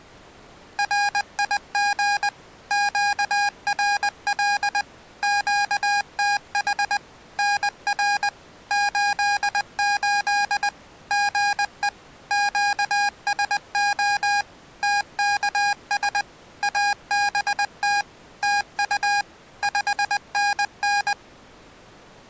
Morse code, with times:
0.8-2.3 RIG
2.7-4.8 QRL
5.2-7.0 QTH
7.4-8.3 NR
8.7-10.7 88
11.1-11.9 GE
12.3-14.4 QSO
14.8-16.2 TKS
16.6-18.0 ABT
18.4-19.2 TU
19.6-21.1 5NN

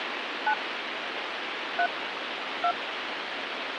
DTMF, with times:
0.5-0.5 9
1.8-1.9 3
2.6-2.7 2

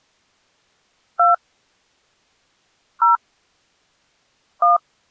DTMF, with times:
1.2-1.3 2
3.0-3.2 0
4.6-4.8 1

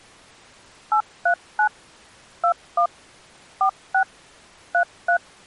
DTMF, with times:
0.9-1.7 839
2.4-2.9 21
3.6-4.0 46
4.7-5.2 33

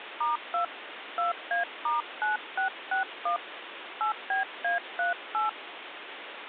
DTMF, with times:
0.2-0.6 *2
1.2-3.4 2A*9661
4.0-5.5 8BA38

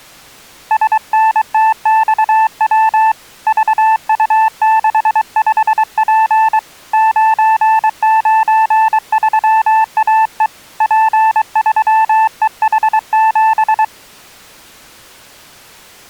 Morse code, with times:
0.7-3.1 SNTXW
3.5-6.6 VU65P
6.9-10.5 993AE
10.8-13.8 P3EH7

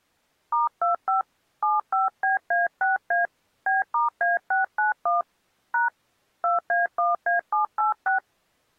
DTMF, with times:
0.5-1.2 *25
1.6-3.3 75BA6A
3.7-5.2 B*A691
5.7-5.9 #
6.4-8.2 2A1A786

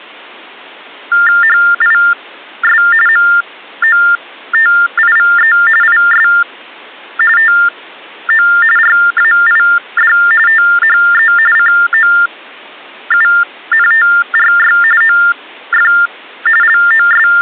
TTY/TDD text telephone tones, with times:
1.4-2.8 HIS
3.1-5.5 MOTIVE
5.8-6.3 IS
7.4-8.5 TO
8.8-10.1 RAID
10.5-11.3 THE
11.6-14.8 COUNTRY
15.0-15.9 OF
16.6-17.4 …

